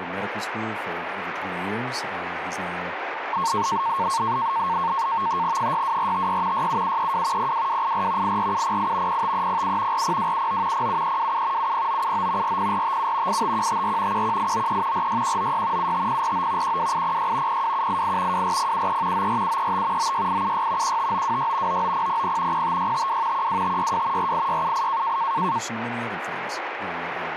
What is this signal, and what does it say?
NAVTEX (SITOR-B), 100 baud, 170 Hz shift, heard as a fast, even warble, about 1000 Hz centre, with radio static. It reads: 62456 67732 02284 84708 05307 40279 07327 70979 40457 85154 11893 46196 75049 12806 02788 24073 94735 96876 15926 99000 05652 12562 48678